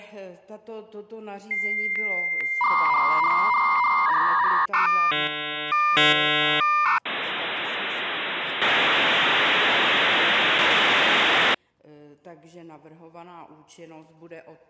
Dial-up modem handshake (V.34 or later), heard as a whistle, warbles, then hiss.